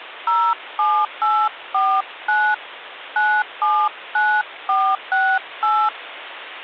DTMF, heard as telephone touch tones, dialled by hand, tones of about 260 ms, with phone line noise. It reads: 07849 979468